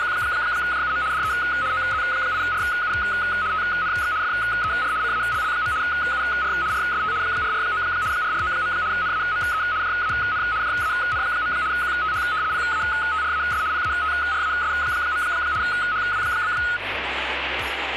RTTY (75 baud, 170 Hz shift), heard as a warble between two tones, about 1360 Hz centre, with radio static. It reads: … DE OZ8RU TNX FER CALL. UR RST 449 449. NAME JAN JAN. QTH PATRAS PATRAS. HW?